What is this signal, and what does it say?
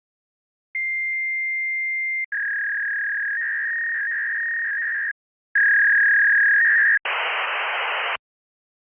Fax machine handshake, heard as a long tone, a warble and hiss.